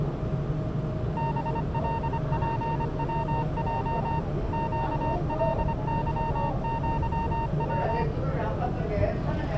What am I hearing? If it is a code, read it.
Morse code (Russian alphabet), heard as a keyed tone, machine-sent, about 25 wpm, 920 Hz, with the noise inside a subway train. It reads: БЛПВЙ ЩЛЫЪВ